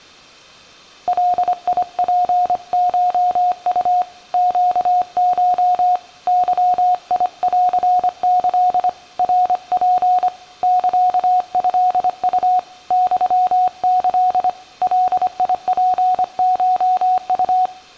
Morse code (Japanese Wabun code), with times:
1.1-4.0 ガツコウ
4.3-6.0 ネコ
6.3-8.9 ゲンキ
9.2-10.3 ナツ
10.6-12.6 サトウ
12.9-14.5 ユキ
14.8-17.7 ガツコウ

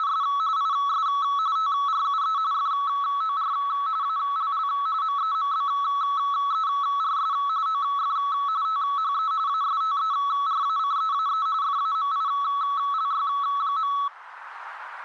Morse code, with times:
none

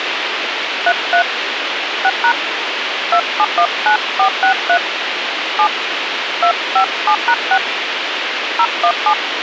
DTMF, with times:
0.9-1.2 33
2.0-2.3 6#
3.1-4.8 2719463
5.6-5.7 7
6.4-7.6 257#6
8.6-9.1 017

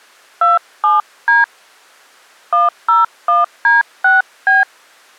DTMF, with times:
0.4-1.4 27D
2.5-4.6 101D6B

